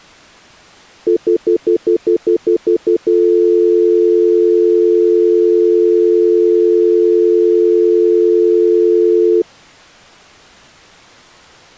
Telephone call progress tone (North American plan), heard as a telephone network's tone, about 350, 440 Hz, 0.1 s on and 0.1 s off. Stutter dial tone.